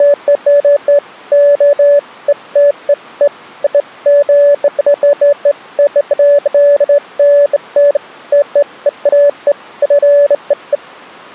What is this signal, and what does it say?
Beeps of irregular length. There is no code.